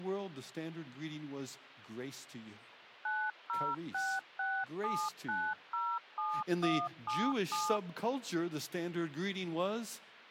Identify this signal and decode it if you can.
DTMF, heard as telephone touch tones, dialled by machine, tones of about 250 ms, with speech in English. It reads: 90667907177